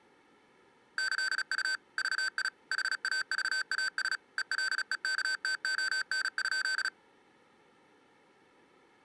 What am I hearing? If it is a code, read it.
Morse code (with Esperanto letters), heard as electronic beeps, machine-sent, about 36 wpm, 1550 Hz. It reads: ĈU VI HAVAS ELEKTON?